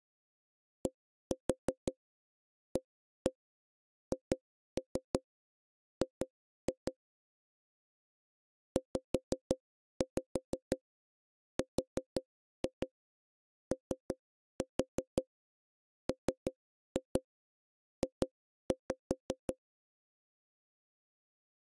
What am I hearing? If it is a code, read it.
Tap code, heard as knocks on wood, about 5 knocks a second. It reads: DAHG ZROMJ